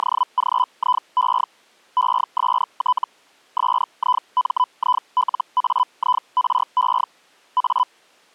Hellschreiber (Feld-Hell, 122.5 baud), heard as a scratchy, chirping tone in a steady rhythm, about 1000 Hz. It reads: … EST SIMILAIRE A